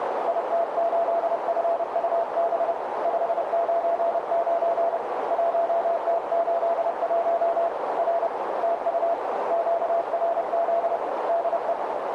Morse code, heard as a keyed tone, hand-sent with a paddle, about 30 wpm, 680 Hz, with heavy radio static and a narrow filter. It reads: IT8FUB 599 1T81 R TU QRZ DE